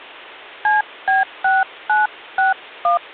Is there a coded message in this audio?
Yes: DTMF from 0.6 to 3.0 s, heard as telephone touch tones, dialled by hand, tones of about 170 ms. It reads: CB6961